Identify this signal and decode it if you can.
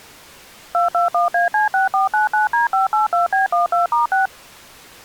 DTMF, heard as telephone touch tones, dialled by machine, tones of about 140 ms. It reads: 221AC6499D582B12*6